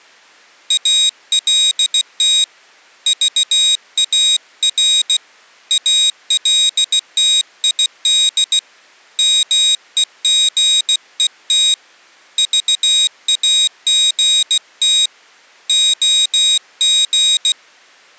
Morse code, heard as a high beeper, hand-sent with a paddle, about 16 wpm, 3800 Hz. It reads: ALT VAR ALTID MEGET VAGT OG